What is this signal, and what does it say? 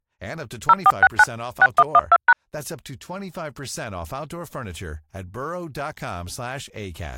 DTMF, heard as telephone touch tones, dialled by machine, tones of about 40 ms, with speech in English. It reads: 0469 6112#